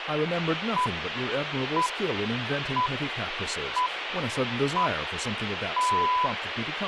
Radio time signal (six pips, as the Greenwich Time Signal), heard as pips, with radio hiss and speech in English.